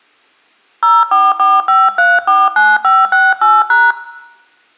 DTMF, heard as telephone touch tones, dialled by hand, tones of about 210 ms, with room echo. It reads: 0445349568#